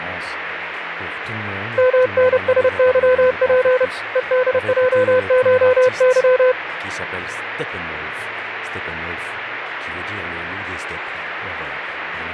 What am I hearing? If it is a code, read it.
Morse code (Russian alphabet), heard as a keyed tone, hand-sent with a paddle, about 30 wpm, 510 Hz, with radio static. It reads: МНСЫП ЕДЙШЫ